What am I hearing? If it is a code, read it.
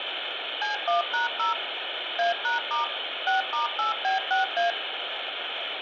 DTMF, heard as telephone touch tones, dialled by machine, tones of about 140 ms, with phone line noise and room echo. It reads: C1#0 A#* 6*8B6A